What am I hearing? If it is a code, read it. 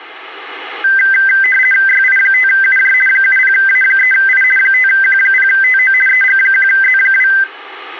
RTTY (50 baud, 450 Hz shift), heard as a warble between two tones, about 1800 Hz centre. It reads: YI5UJ 70A3I 5Q0TO EG1Z2